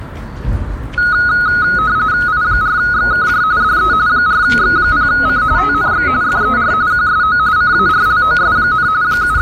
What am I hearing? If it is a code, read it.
RTTY (45.45 baud, 170 Hz shift), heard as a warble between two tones, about 1360 Hz centre, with the noise of a park. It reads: I4XKJ DE 4X0C TNX FER QSO CARLOS, …